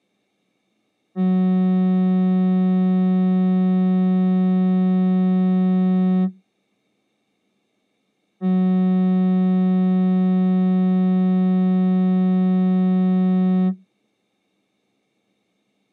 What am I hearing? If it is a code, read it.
Ship horn signal, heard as a ship's horn, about 180 Hz. 2 long. At sea: a vessel under power that has stopped in fog.